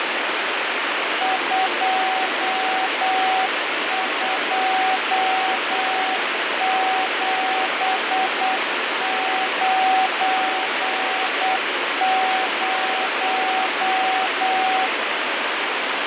Morse code, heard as a keyed tone, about 8 wpm, 760 Hz, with heavy radio static and fading. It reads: 22790